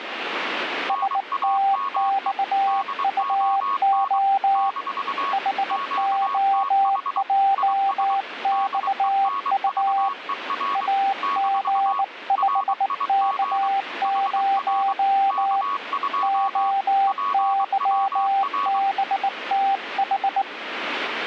Morse code, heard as two keyed tones, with radio static. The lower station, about 19 wpm, 790 Hz: STXUO HOJXU AG5K0 OYBTH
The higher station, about 23 wpm, 1110 Hz: NAME DON - QTH IS DENVER - RIG HR K2 PWR